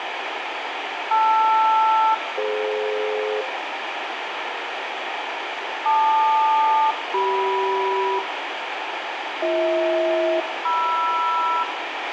Aircraft SELCAL, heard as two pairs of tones, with radio hiss, a squelch burst at the end and room echo. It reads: LR-DF LQ-CM BH-MR